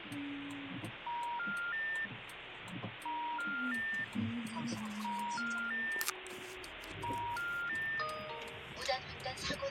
Telephone call progress tone (ITU plan), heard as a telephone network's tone, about 950, 1400, 1800 Hz, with phone line noise and the noise inside a car. Special information tone.